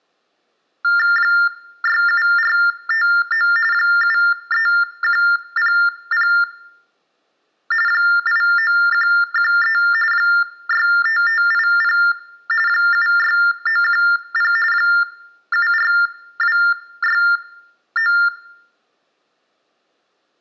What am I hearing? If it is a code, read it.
TTY/TDD text telephone tones (45.45 baud Baudot), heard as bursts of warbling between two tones, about 400 Hz shift, 1600 Hz centre, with room echo. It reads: 67459 73100 89113 65580 76910 74269